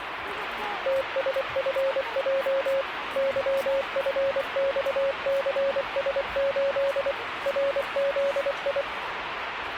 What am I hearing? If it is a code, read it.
Morse code, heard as a keyed tone, machine-sent, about 24 wpm, 550 Hz, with radio static and the noise of a park. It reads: TSFJ YFXCS8 RZI